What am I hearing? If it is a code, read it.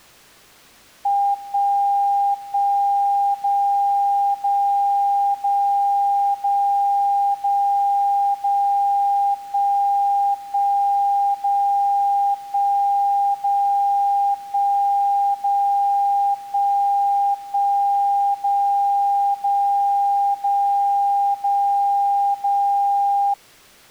Radio time signal (DCF77), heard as a tone whose level steps once a second, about 800 Hz. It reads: 1 1 0 0 0 0 0 0 1 1 0 1 0 1 0 1 1 0 0 0 0 0